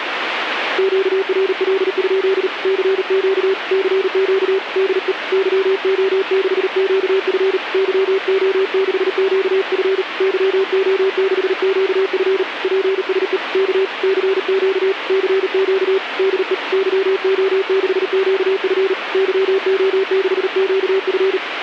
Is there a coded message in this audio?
Yes: Morse code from 0.7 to 21.4 s, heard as a keyed tone, hand-sent with a paddle, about 38 wpm, 390 Hz, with radio static. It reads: QRL? CQ CQ DE YO6QF YO6QF YO6QF PSE K CQ CQ DE YO6QF YO6QF